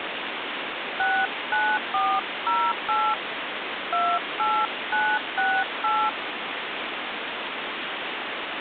DTMF, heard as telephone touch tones, dialled by hand, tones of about 250 ms, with phone line noise. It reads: 69408 28968